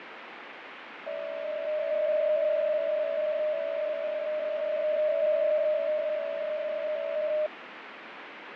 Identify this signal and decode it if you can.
PSK63 (62.5 baud), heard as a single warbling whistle, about 610 Hz, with radio static and fading.